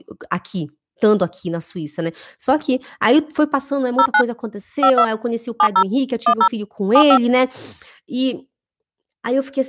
DTMF, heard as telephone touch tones, dialled by hand, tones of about 70 ms, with speech in Portuguese. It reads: 09 52 70 10 75